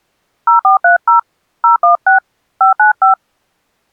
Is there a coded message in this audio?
Yes: DTMF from 0.5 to 3.1 s, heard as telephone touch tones, dialled by hand, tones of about 120 ms. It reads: 0430 016 595